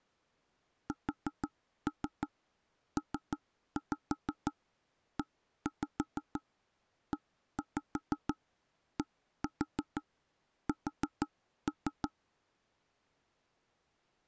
Tap code, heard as knocks on wood, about 6 knocks a second. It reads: SPEEDS